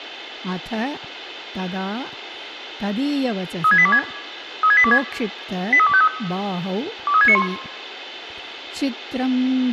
Five-tone selective call (ZVEI), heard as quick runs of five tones, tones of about 70 ms, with a squelch burst at the end, room echo and speech in English. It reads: 36826 36826 83253 23691